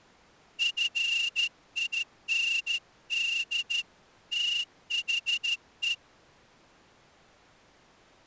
Morse code, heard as a whistle, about 13 wpm. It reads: FIND THE